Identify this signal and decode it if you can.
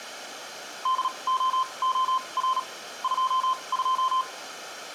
Morse code, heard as a keyed tone, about 37 wpm, spaced as for 27 wpm, 1040 Hz, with room echo. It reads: DOOR 22